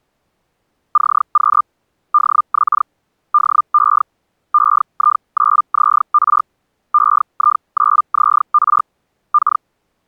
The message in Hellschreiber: CQ DX DE EI9ZR EI9ZR K

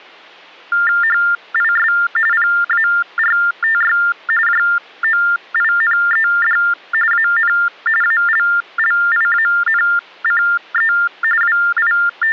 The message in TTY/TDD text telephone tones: HIS PARTY JOINED AN ALLIANCE …

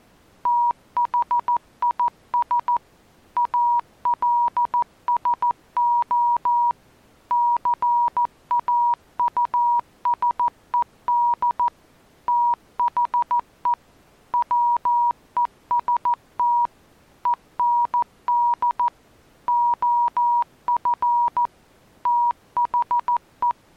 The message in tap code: none

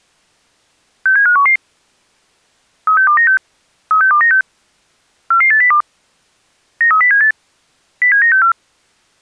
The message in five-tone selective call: 67511 36296 36296 44802 93078 07964

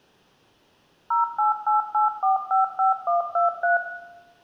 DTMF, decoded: 0888455123

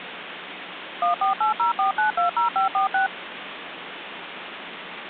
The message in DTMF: 14804920546

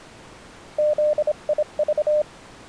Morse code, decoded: ZIV

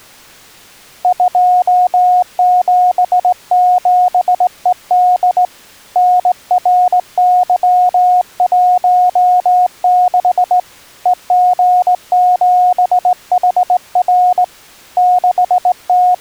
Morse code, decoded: 277ED NRY16 EG7HR …

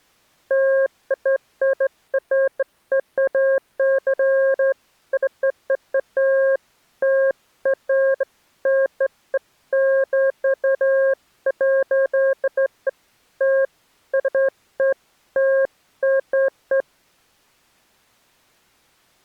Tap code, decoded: none

